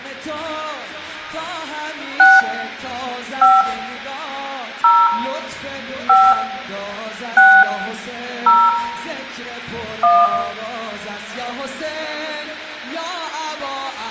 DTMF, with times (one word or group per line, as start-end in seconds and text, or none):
2.2-2.4 6
3.4-3.6 5
4.8-5.1 0
6.1-6.3 5
7.4-7.6 6
8.5-8.7 0
10.0-10.3 1